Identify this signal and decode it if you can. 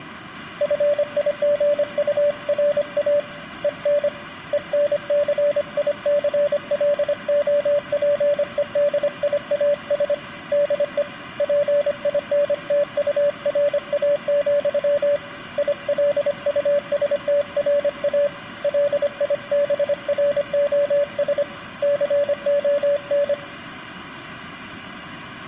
Morse code, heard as a keyed tone, hand-sent with a paddle, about 25 wpm, 580 Hz. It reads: FIGURA EN ENCICLOPEDIAS DE PINTURA, ILUSTRA LIBROS CON